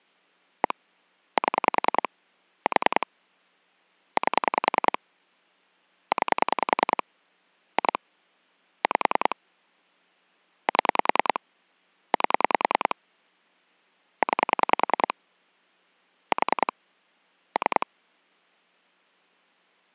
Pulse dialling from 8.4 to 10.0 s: 5

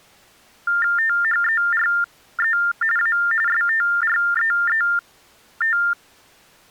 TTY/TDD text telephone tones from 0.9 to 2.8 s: THERE

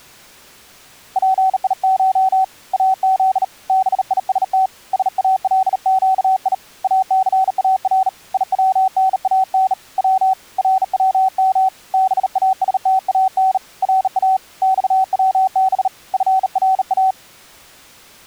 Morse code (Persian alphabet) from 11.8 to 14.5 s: باستان را

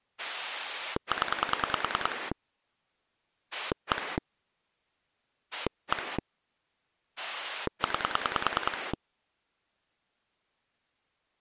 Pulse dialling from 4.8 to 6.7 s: 1

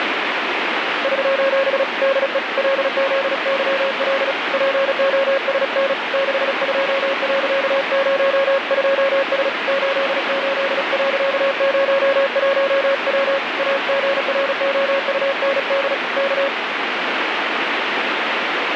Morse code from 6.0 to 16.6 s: 62.02S 88.01W AGROUND K

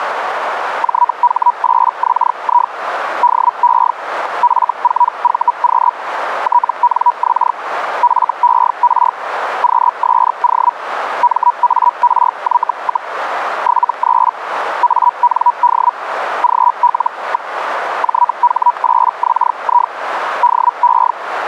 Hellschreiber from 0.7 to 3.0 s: JH8XI

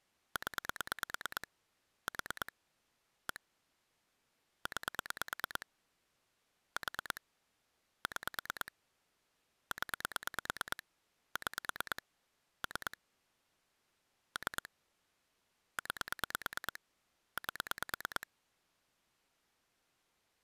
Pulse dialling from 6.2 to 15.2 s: 4 6 0 6 3 3

